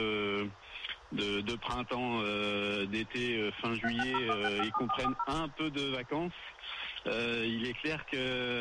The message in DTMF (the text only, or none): 3601657440